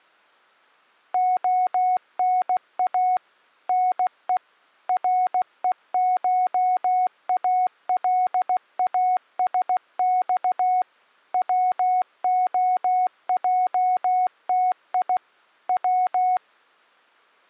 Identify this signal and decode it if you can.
Morse code (Russian alphabet), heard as a keyed tone, machine-sent, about 16 wpm, 740 Hz. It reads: ОНА НЕ РЕШАЛАСЬ ВОЙТИ В